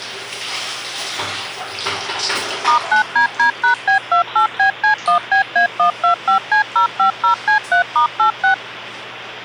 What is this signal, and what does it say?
DTMF, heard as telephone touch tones, dialled by machine, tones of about 110 ms, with the noise of a restroom. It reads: *9DD#B28BC1BA125C050C3*86